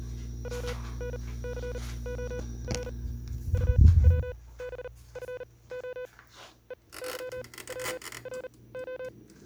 Morse code, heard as a keyed tone, machine-sent, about 39 wpm, spaced as for 22 wpm, 500 Hz, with kitchen noise. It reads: WNCOR UWBFO EYWRO